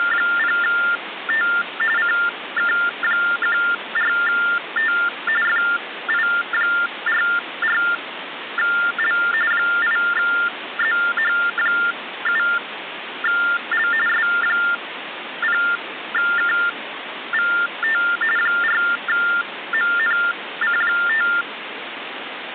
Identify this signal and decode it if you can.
TTY/TDD text telephone tones (45.45 baud Baudot), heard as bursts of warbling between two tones, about 400 Hz shift, 1600 Hz centre, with phone line noise. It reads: … CK14T FI44L 8ZH7L S0KVT 4MNC5